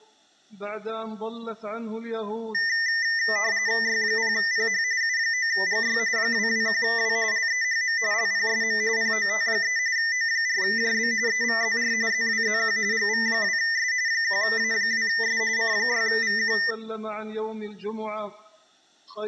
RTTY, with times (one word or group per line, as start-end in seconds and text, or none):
3.8-4.8 Y0PH
5.0-6.0 U9GY
6.2-7.2 221W
7.3-8.0 LEHM
8.1-8.8 LPSM
9.0-9.8 POT3
10.0-11.1 O4JB
11.3-11.9 EVZR
12.1-12.8 ZWZQ
12.9-13.9 GV2S
14.1-15.4 1A2S
15.6-16.6 C6VQ